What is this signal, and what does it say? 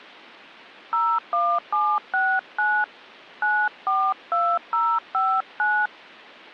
DTMF, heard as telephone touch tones, dialled by hand, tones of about 260 ms. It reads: 01769 942059